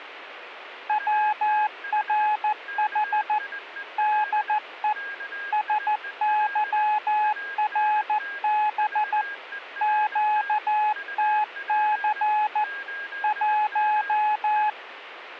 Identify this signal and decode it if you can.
Morse code, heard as a keyed tone, machine-sent, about 14 wpm, 850 Hz, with a weaker station near 1620 Hz. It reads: WRH DE SYRB QTC 1